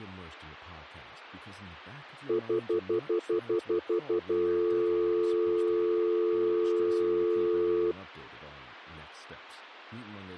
Telephone call progress tone (North American plan), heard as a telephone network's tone, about 350, 440 Hz, 0.1 s on and 0.1 s off, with speech in English. Stutter dial tone.